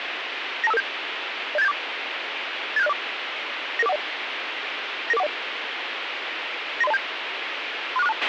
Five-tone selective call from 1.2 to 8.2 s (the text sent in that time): 07874 87604 99410 99410 93027 36462